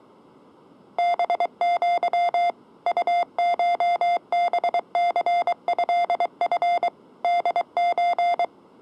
Morse code (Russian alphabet), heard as electronic beeps, machine-sent, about 23 wpm, 700 Hz. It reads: БЪ УШБЦЭФ ДЧ